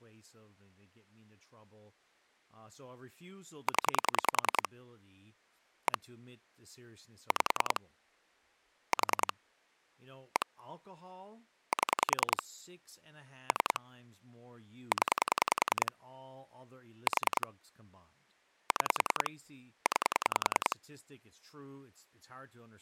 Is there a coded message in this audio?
Yes: pulse dialling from 3.7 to 20.7 s, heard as clicks on a phone line, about 10 pulses a second, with speech in English. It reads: 0 1 5 4 1 7 3 0 4 6 9